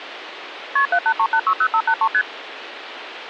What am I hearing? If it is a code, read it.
Multi-frequency trunk signalling (R1, as on North American trunks), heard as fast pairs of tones, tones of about 70 ms, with phone line noise. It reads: KP 783860583 ST